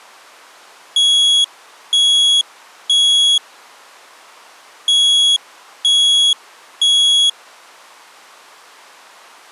Alarm pattern, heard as an alarm's beeps, played twice, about 3350 Hz. Temporal three. Smoke or fire, evacuate.